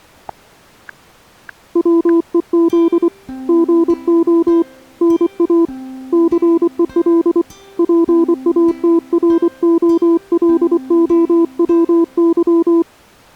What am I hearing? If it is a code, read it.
Morse code, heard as a keyed tone, hand-sent with a paddle, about 24 wpm, 330 Hz. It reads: WEZ GO NA CEL PATROLOWY